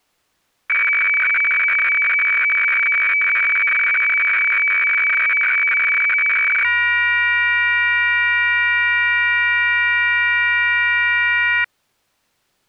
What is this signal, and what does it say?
Weather fax (radiofax), 120 lines a minute, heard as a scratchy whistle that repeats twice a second.